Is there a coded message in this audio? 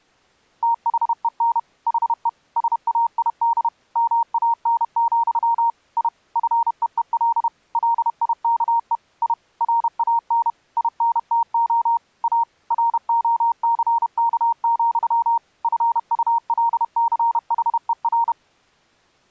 Yes: Morse code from 0.6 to 18.4 s, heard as a keyed tone, machine-sent, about 31 wpm, 930 Hz. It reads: THEN HE SAID MAN, I FEEL LIKE I RAN INTO A ROCK, FULCHER